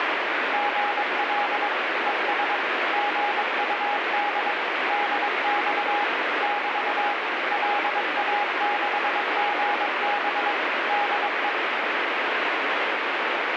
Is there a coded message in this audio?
Yes: Morse code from 0.5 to 11.6 s, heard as a keyed tone, machine-sent, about 22 wpm, 820 Hz, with heavy radio static. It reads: GL ES GUD DX <BT> LA6GB DE